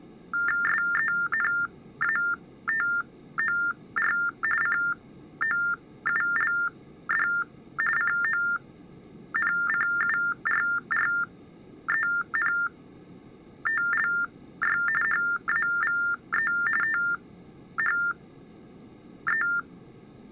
TTY/TDD text telephone tones (45.45 baud Baudot), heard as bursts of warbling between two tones, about 400 Hz shift, 1600 Hz centre. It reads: SENATOR COULD CONCURRENTLY HAVE THE